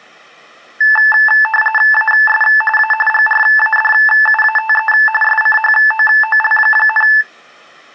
RTTY (45.45 baud, 850 Hz shift), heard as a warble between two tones, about 1310 Hz centre. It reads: AS A GRADUATE SCHOOL,